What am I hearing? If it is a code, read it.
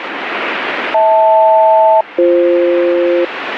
Aircraft SELCAL, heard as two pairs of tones, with radio static. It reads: HL-BF